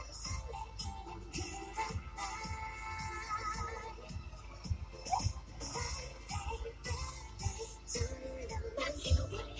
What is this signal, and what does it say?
The noise inside a car. There is no code.